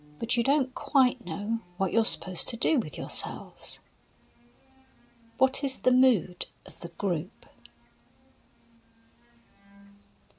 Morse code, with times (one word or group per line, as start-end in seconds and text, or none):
none